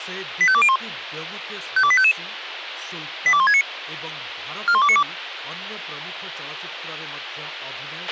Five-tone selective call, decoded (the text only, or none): 85201 52855 82169 41292